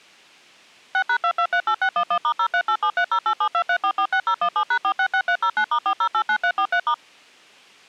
DTMF, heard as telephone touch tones, dialled by machine, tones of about 80 ms. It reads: 6#2238611*0387308723446017#466309*4089343*